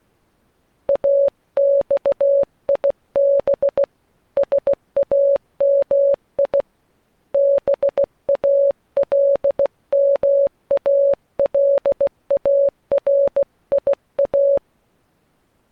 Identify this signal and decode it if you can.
Morse code (Arabic alphabet), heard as a keyed tone, hand-sent with a bug key, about 16 wpm, 560 Hz. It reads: اصيب سامي بالمالاريا